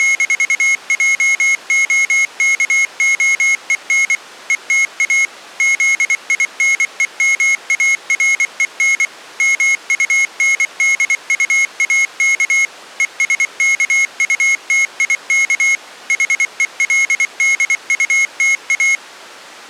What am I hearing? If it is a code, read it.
Morse code, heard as a high beeper, machine-sent, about 24 wpm, 2150 Hz. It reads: … ETA ZINEMAREN MUNDUAK ESKUTIK HELDUTA